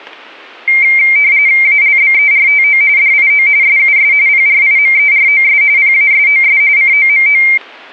RTTY (45.45 baud, 170 Hz shift), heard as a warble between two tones, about 2200 Hz centre. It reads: ALBERTO DIO SUS PRIMEROS PASOS COMO